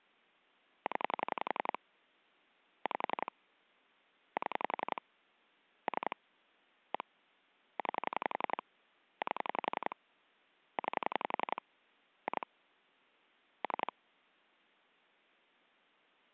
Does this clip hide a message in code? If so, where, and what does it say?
Yes: pulse dialling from 0.9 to 13.9 s, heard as clicks on a phone line, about 11 pulses a second. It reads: 0 5 7 3 1 9 8 9 2 3